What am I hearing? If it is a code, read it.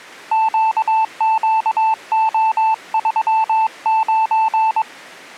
Morse code, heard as a keyed tone, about 22 wpm, 880 Hz. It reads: QQO39